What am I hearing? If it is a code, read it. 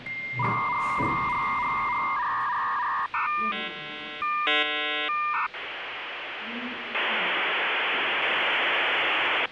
Dial-up modem handshake (V.34 or later), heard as a whistle, warbles, then hiss, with phone line noise and the noise inside a lift.